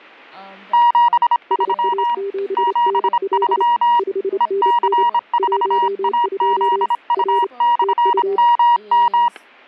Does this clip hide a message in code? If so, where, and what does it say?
Yes: Morse code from 0.7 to 9.3 s, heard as two keyed tones, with static crashes and speech in English. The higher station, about 26 wpm, 950 Hz: 73 73 EC4AZU/MM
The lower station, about 28 wpm, 400 Hz: SA7NL 5NN 12 R TU